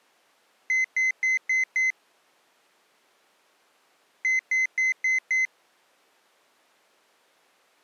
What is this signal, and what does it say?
Beep code, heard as a piezo beeper, played twice, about 2050 Hz. 5 short. In AMI BIOS tables: processor failure; in Dell tables: CMOS battery failure.